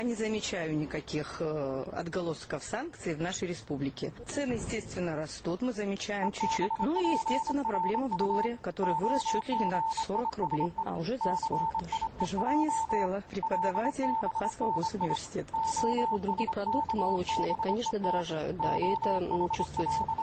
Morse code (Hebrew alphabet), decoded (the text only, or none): ובפרט הגישו סיוע לבני השכבות …